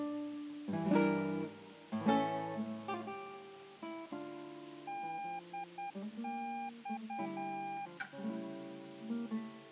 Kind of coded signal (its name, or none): Morse code